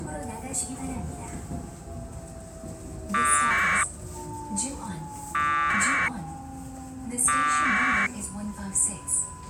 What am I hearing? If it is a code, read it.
Packet radio (AX.25, as in APRS), 1200 baud, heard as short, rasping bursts, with the noise inside a subway train.